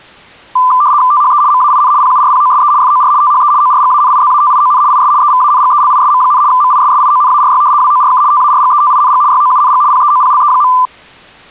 RTTY (75 baud, 170 Hz shift), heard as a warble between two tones, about 1100 Hz centre. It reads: THE MAIN PURPOSE FOR THE ORGANIZATION IS EVANGELISM, MISSIONARY WORK TARGETING YOUNG PEOPLE.